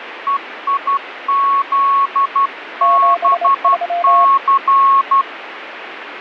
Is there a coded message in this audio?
Yes: Morse code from 0.2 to 5.3 s, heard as two keyed tones, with radio static. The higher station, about 12 wpm, 1100 Hz: EIZBC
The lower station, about 26 wpm, 690 Hz: 73